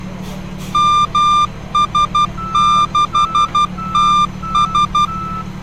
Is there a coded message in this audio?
Yes: Morse code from 0.7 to 5.1 s, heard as a keyed tone, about 12 wpm, 1190 Hz, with street noise. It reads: MS6TS